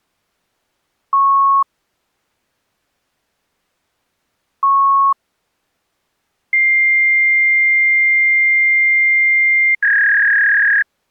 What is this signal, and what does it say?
Fax machine handshake, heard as beeps, a long tone and a warble.